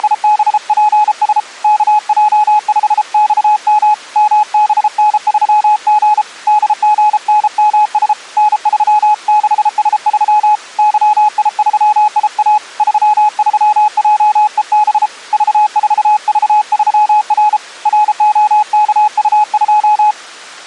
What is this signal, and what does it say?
Morse code, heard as a keyed tone, hand-sent with a paddle, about 33 wpm, 840 Hz. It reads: … KJ5XM MBN3G DGNMS N36S3 YI3IA 33JEB V4V3R ROKU2